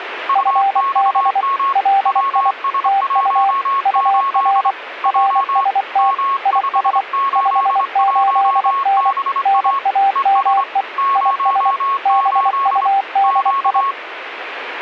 Morse code, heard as two keyed tones, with radio static. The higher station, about 25 wpm, 1100 Hz: UXM WS18 J M581BA ES 08 Q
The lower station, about 24 wpm, 790 Hz: FB LI TU UR RST IS 58N NAME IS BUDI